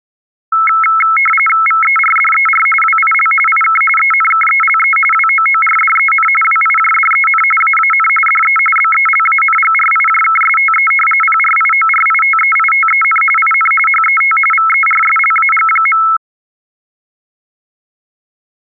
RTTY (45.45 baud, 850 Hz shift), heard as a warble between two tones, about 1750 Hz centre. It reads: VERDER WIL IK ENKELE WOORDEN WIJDEN AAN DE BELANGRIJKSTE PRIORITEITEN IN HET VERSLAG.